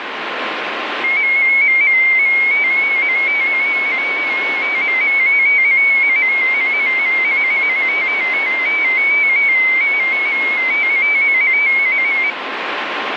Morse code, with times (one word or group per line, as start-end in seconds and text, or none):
none